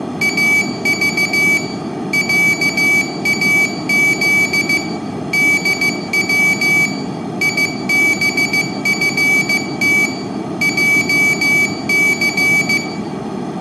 Morse code (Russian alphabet), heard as a high beeper, machine-sent, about 15 wpm, 2300 Hz, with room echo. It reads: АЖ ЯАЗ ДВ ИБФТ ЙЦ